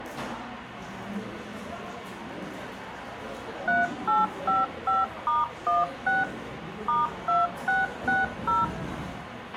DTMF, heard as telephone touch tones, dialled by machine, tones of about 180 ms, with radio hiss, a squelch burst at the end and the noise of a crowd indoors. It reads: 3855*16 *2660